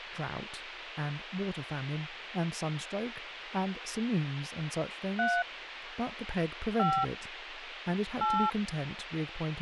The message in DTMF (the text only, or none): 3 5 8